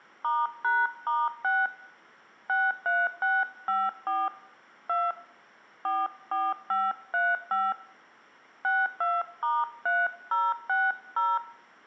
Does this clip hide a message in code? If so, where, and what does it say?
Yes: DTMF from 0.2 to 11.4 s, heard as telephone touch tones, dialled by hand, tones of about 210 ms, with room echo. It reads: *#*6 63654 2 44535 62*3060